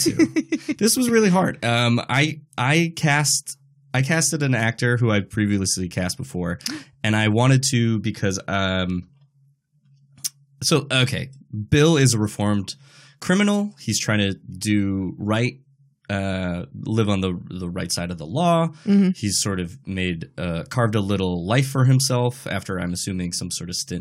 Speech in English. There is no code.